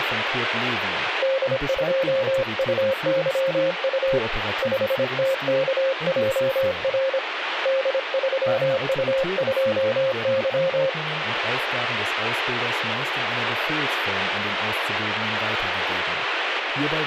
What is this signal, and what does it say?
Morse code, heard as a keyed tone, hand-sent with a paddle, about 26 wpm, 530 Hz, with radio static. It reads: D2UYU 5TKJR D3U2Y